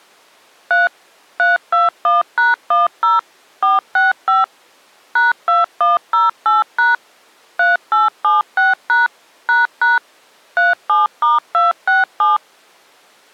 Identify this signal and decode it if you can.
DTMF, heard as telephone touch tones, dialled by machine, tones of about 160 ms. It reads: 3 321#10 465 #2108# 3876# ## 37*267